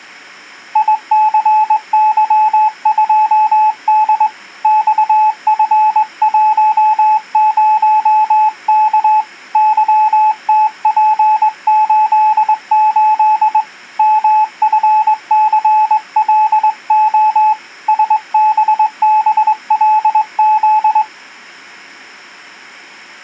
Morse code, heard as a keyed tone, hand-sent with a straight key, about 21 wpm, 860 Hz. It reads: ICY2D XF10K YTP88 MFCLO SBBLZ